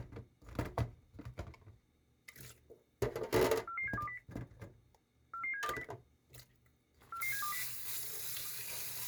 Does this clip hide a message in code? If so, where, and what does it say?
Yes: five-tone selective call (CCIR) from 3.7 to 7.6 s, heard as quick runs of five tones, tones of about 100 ms, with kitchen noise. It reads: 44720 44720 44720